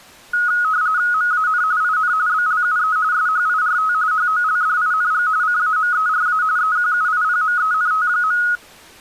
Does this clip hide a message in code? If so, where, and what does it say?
Yes: RTTY (45.45 baud, 170 Hz shift) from 0.3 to 8.6 s, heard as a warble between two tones, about 1360 Hz centre. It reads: MAN IN BLUE SHIRT HOLDING CAMERA EQUIPMENT.